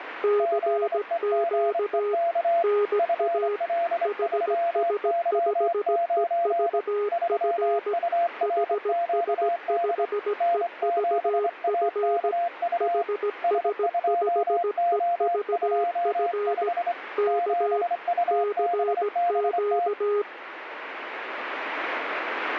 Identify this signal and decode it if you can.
Morse code, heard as two keyed tones, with radio static. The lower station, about 17 wpm, 410 Hz: CQ NA HS5EVF HS5EVF HS5EVF K CQ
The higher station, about 25 wpm, 690 Hz: ZEGEK FL3Y9 3URQD N7AKU S2O25 7UBBT